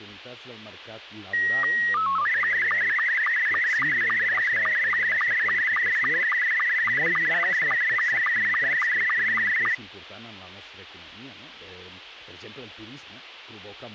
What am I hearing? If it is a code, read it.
SSTV (slow-scan television), Scottie S2, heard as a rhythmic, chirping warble, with speech in Catalan.